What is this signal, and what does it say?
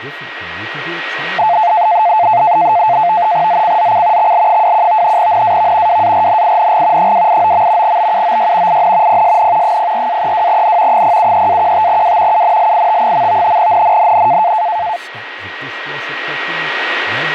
NAVTEX (SITOR-B), 100 baud, 170 Hz shift, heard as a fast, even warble, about 780 Hz centre, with radio static, a steady whistle near 1900 Hz and speech in English. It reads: ZCZC XL21 NAV WARNING 289. BUOY IN PSN 04-32N 073-15W UNLIT. NNNN